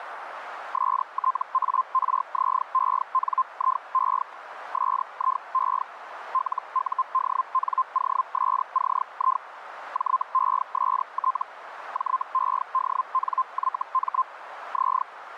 Hellschreiber (Feld-Hell, 122.5 baud), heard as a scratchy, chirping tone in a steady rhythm, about 1040 Hz, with radio static. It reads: STARZENIE SIE LUDNOSCI JEST JEDNYM Z